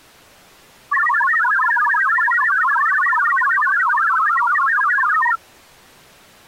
Multi-tone FSK (Olivia or MFSK type), about 1000 Hz wide, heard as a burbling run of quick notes, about 62.5 baud.